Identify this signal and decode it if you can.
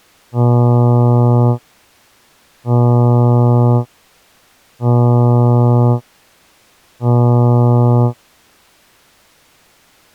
Ship horn signal, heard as a ship's horn, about 120 Hz. 4 short. At sea: a pilot vessel's identity signal in fog.